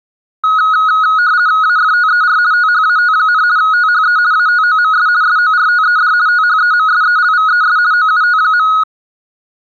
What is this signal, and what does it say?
RTTY (50 baud, 170 Hz shift), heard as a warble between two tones, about 1360 Hz centre. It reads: AFTER THAT, THE ATOMS SORTED THEMSELVES OUT.